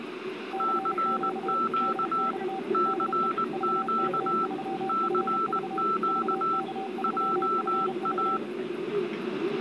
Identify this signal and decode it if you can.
Morse code, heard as two keyed tones, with radio static and the noise of a park. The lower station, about 32 wpm, 770 Hz: CQ DX DE VK3FV VK3FV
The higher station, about 19 wpm, 1330 Hz: CQ CQ CQ JA